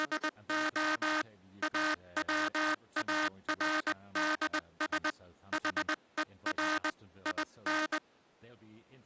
Morse code, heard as a buzzer, hand-sent with a paddle, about 20 wpm, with speech in English. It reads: … AWARDS HER IN